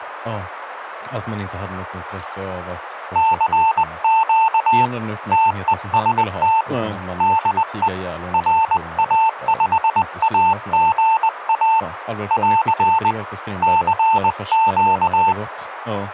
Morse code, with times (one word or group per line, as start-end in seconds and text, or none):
3.2-4.9 CQ
5.3-6.6 TEST
7.2-7.9 DE
8.3-11.8 RA5AGA
12.3-13.1 <AR>
13.6-15.3 CQ